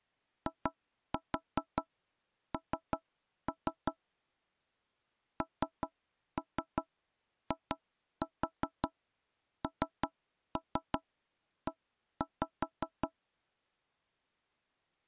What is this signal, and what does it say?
Tap code, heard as knocks on wood, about 5 knocks a second. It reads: IN NINE